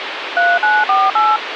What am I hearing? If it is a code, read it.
DTMF, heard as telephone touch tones, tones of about 210 ms, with phone line noise. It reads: 3948